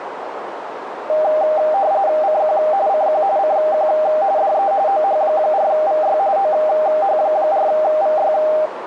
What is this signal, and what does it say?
RTTY (45.45 baud, 170 Hz shift), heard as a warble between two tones, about 700 Hz centre, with radio static and a narrow filter. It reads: CQ CQ CQ DE OH4VY OH4VY